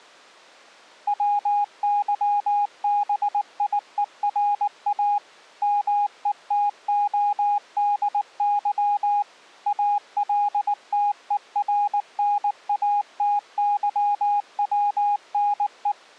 Morse code, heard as a keyed tone, machine-sent, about 19 wpm, 820 Hz. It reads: WYBIERA METODY ALTERNATYWNE